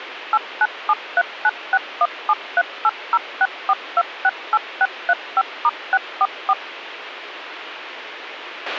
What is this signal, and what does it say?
DTMF, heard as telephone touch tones, dialled by machine, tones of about 50 ms, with radio hiss and a squelch burst at the end. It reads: 8973961738064268635*644